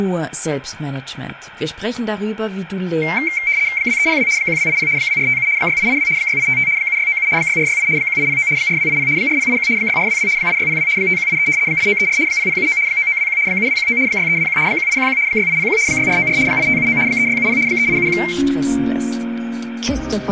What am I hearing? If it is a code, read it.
RTTY (75 baud, 170 Hz shift), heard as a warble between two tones, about 2200 Hz centre, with static crashes and room echo. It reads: 2302 1280 2457 6882 6855 7697 6468 1809 4280 4081 6422 8602 5183 8934 0079 9921 7219 6321 1811 6801 6494 8579 3670 3871